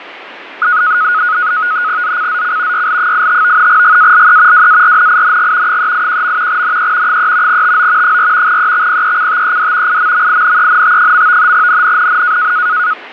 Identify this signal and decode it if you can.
NAVTEX (SITOR-B), 100 baud, 170 Hz shift, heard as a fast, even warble, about 1360 Hz centre, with radio static and fading. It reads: ZCZC YL85 GALE WARNING 381. NE 3 TO 4 EXPECTED IMMINENT. NNNN